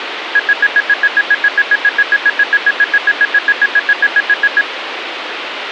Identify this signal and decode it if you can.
Evenly repeated beeps, with phone line noise. There is no code.